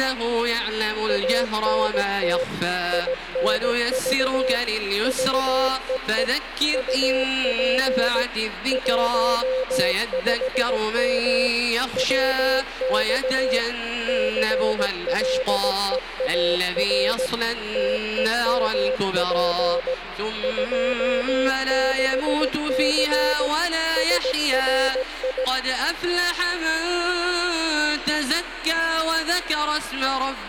Morse code, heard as a keyed tone, machine-sent, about 17 wpm, 520 Hz, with radio static. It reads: ANT INV VEE UP 15M WX CLEAR TEMP 26C SRI